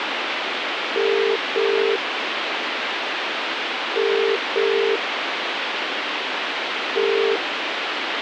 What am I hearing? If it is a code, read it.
Telephone call progress tone (as in the UK, Ireland, Australia and similar networks), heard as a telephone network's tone, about 400, 450 Hz, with phone line noise. Ringback tone.